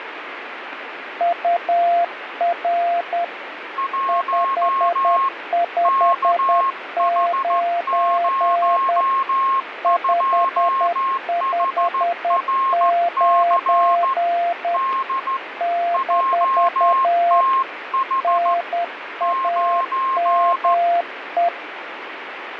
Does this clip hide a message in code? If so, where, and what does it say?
Yes: Morse code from 1.1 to 21.5 s, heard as two keyed tones, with radio static. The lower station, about 10 wpm, 690 Hz: UR 559 559 - NAME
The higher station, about 14 wpm, 1070 Hz: 1 KH02HRC D JTH 9